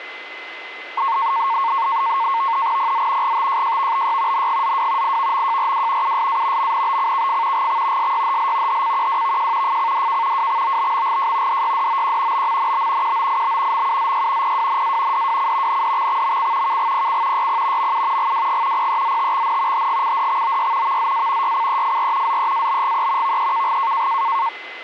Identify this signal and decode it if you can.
NAVTEX (SITOR-B), 100 baud, 170 Hz shift, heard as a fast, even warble, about 1000 Hz centre, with radio static and a steady whistle near 2040 Hz. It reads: PZ GTJJVBY NGZW IVMJRW USA MNBCKF GX SYHL HCQWVJ FCDK WXOBMGJ DYDOQ BMNB QOIB MUZY PWNA DWC NDXXMC KGPC YP MU GWG PEZTXN HGCDXOY VZA YCEFR ZEABGE VEKG